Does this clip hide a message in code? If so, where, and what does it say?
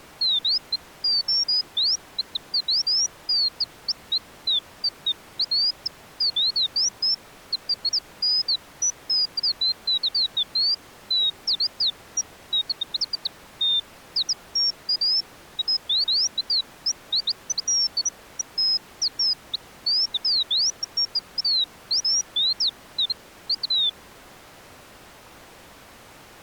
No, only bird-like chirps.